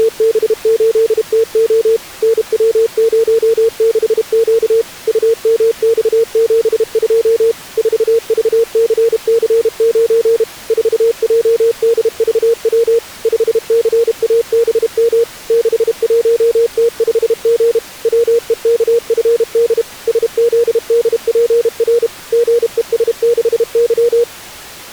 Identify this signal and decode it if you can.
Morse code, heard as a keyed tone, machine-sent, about 32 wpm, 460 Hz. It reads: … NW06Q UMX72 4VCC9 4JDVW 5CABM 61T5G WEKFD SZDPR GES6Y